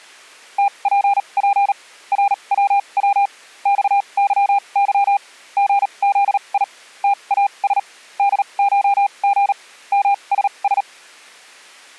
Morse code (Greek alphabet), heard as a keyed tone, machine-sent, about 38 wpm, spaced as for 29 wpm, 800 Hz. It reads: ΤΠΠ ΡΩΩ ΞΥΥ ΓΖΙ ΤΑΣ ΔΧΓ ΜΣΣ